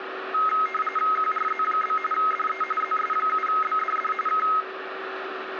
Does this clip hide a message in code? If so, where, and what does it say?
Yes: RTTY (45.45 baud, 850 Hz shift) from 0.3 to 4.6 s, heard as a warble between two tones, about 1700 Hz centre, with radio static and a steady whistle near 380 Hz. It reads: QRZ? DE ZS7BDD K